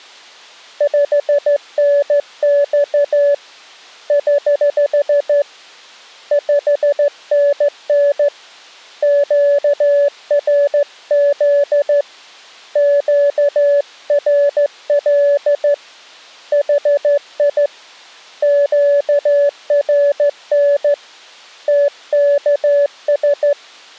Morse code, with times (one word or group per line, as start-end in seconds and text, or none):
0.8-3.3 5NX
4.1-5.4 <HH>
6.3-8.3 5NN
9.0-12.0 QRZ
12.8-15.7 QRL
16.5-17.7 HI
18.4-20.9 QRN
21.7-23.5 TKS